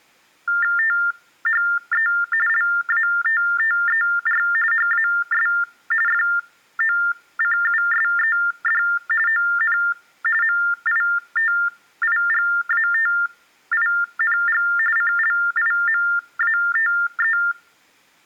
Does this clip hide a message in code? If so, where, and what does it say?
Yes: TTY/TDD text telephone tones (45.45 baud Baudot) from 0.5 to 17.5 s, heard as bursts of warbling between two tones, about 400 Hz shift, 1600 Hz centre. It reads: THE LATTER HAS FOCUSED ON MITIGATING CLIMATE